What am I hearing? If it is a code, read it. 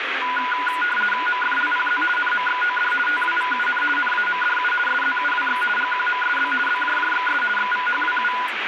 RTTY (50 baud, 450 Hz shift), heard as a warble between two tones, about 1220 Hz centre, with radio static and speech in Bodo. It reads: MFLPZ NMXOD TWVUN NAMDU SZUWX GQMSB BJJXS XVHWU